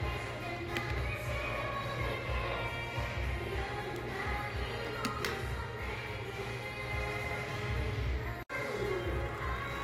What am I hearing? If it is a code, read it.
The noise of a crowd indoors. There is no code.